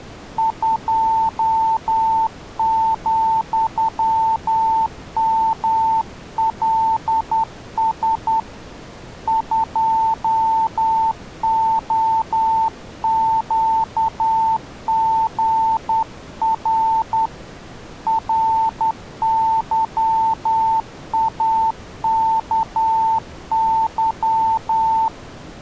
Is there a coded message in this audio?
Yes: Morse code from 0.3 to 25.1 s, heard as a keyed tone, hand-sent with a straight key, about 10 wpm, 890 Hz. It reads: 2,MLS 2OQGR RYAKY